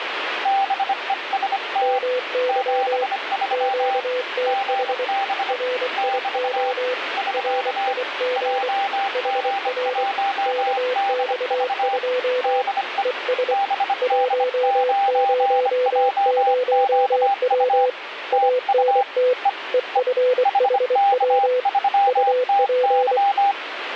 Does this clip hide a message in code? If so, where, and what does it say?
Yes: Morse code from 0.4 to 23.6 s, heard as two keyed tones, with radio static. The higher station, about 25 wpm, 790 Hz: BEST 73 GB <BT> <SK> JG1DV DE BD9JQU TU E E HK3TY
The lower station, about 24 wpm, 500 Hz: MY QTH RIO RIG HR KX2 ES 100W ANT EFHW UP